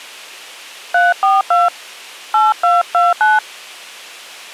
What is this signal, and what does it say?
DTMF, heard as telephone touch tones, dialled by hand, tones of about 180 ms. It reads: 342 8229